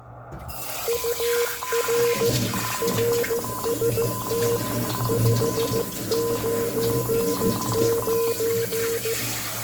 Morse code, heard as two keyed tones, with room echo and kitchen noise. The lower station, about 15 wpm, 470 Hz: UR RST 599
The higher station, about 23 wpm, 1020 Hz: TNX FER QSO KAZU